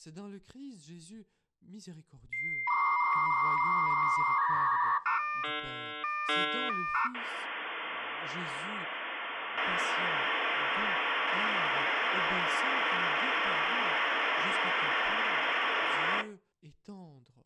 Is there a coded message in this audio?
Yes: dial-up modem handshake (V.34 or later) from 2.3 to 16.2 s, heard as a whistle, warbles, then hiss, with speech in French.